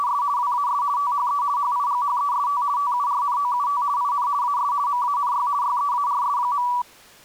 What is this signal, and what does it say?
RTTY (50 baud, 170 Hz shift), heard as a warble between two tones, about 1060 Hz centre. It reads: … WAS THE HIGHEST TURNOUT IN AS MANY YEARS.